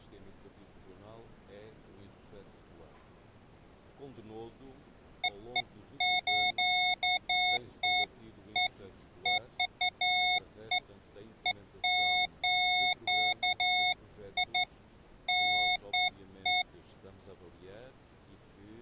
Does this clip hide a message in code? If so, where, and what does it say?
No, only beeps of irregular length.